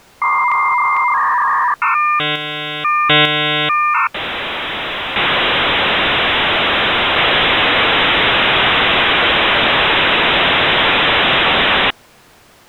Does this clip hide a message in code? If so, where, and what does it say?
Yes: dial-up modem handshake (V.34 or later) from 0.2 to 11.9 s, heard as a whistle, warbles, then hiss.